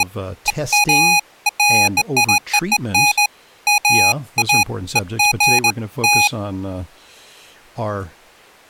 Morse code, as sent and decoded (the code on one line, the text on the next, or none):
none